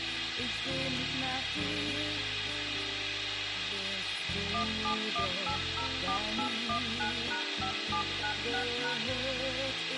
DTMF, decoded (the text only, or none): 171804819#5796#